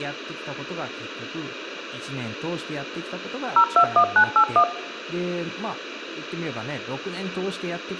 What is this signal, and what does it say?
DTMF, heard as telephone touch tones, dialled by machine, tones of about 80 ms, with speech in Japanese. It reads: 021981